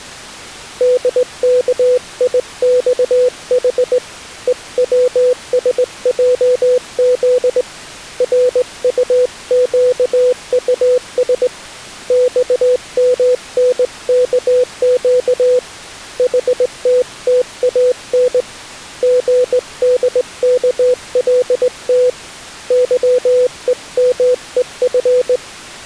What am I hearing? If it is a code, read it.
Morse code, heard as a keyed tone, hand-sent with a straight key, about 19 wpm, 500 Hz. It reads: DKIXH EWSJZ RUQUS XMNKQ HTTAN GDKLT YEMEF